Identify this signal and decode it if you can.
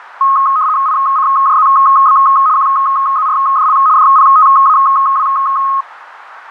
RTTY (75 baud, 170 Hz shift), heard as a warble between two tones, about 1170 Hz centre, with radio static. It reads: ICJZB QZRDL DPTAW